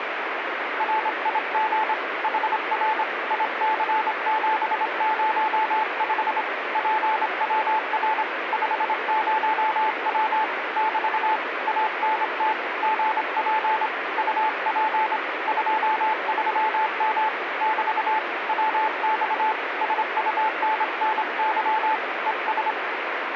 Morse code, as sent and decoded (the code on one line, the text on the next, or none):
.-. .. --. / .... .-. / .. -.-. --... ----- ..... / .--. .-- .-. / ..... ----- .-- / -...- / .- -. - / --. .--. / ..- .--. / ..--- ...-- -- / -...- / .-- -..- / ... ..- -. -. -.-- / . ...
RIG HR IC705 PWR 50W <BT> ANT GP UP 23M <BT> WX SUNNY ES